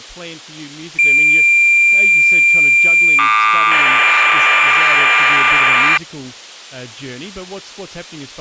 Cassette data (Kansas City type), 1200 baud, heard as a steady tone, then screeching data, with speech in English.